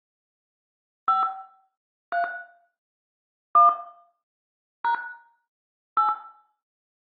DTMF, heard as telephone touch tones, dialled by hand, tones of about 130 ms, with room echo. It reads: 5 3 1 # 8